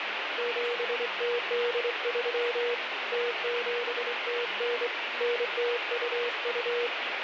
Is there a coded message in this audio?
Yes: Morse code (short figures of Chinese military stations) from 0.3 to 6.9 s, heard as a keyed tone, hand-sent with a straight key, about 25 wpm, 480 Hz, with radio static and speech in Kannada. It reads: 7083 0709 9022